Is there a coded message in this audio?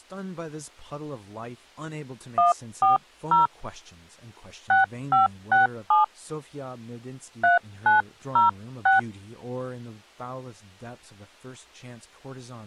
Yes: DTMF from 2.4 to 9.0 s, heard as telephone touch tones, dialled by hand, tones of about 140 ms, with speech in English. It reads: 140 6567 3906